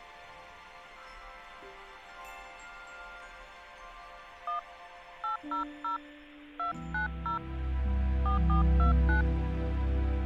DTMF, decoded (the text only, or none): 1 800 290 4429